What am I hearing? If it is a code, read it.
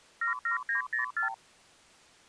Multi-frequency trunk signalling (R2, with the far end's replies), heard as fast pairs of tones, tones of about 120 ms. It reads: 77904